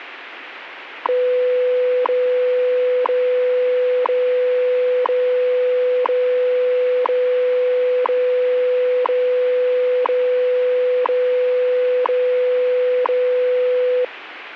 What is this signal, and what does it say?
Radio time signal (WWV, Colorado), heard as ticks, one a second, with radio static.